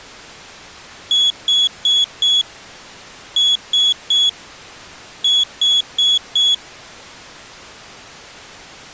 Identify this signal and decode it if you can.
Beep code, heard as a piezo beeper, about 3350 Hz. 4-3-4. In Phoenix BIOS tables: time-of-day clock failure.